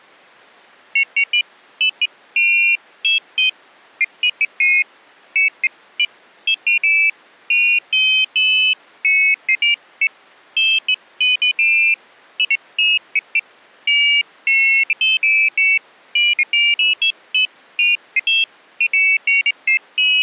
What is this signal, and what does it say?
Pairs of high tones at irregular times. There is no code.